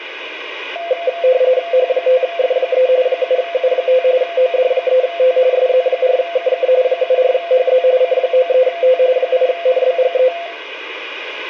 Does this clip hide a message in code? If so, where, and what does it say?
Yes: RTTY (45.45 baud, 170 Hz shift) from 0.8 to 10.5 s, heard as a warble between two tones, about 600 Hz centre, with radio static and room echo. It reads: H5F3 7U5 OD3T SZ4KK 74HZ C93T 8NBGE